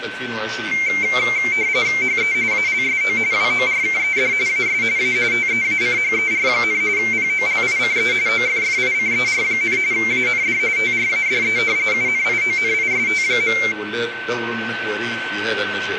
RTTY (45.45 baud, 170 Hz shift), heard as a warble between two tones, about 2200 Hz centre, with radio static and a steady whistle near 1530 Hz. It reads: HE ALSO WORKED AS A TEACHER, POLICE OFFICER, AND TRADE UNIONIST.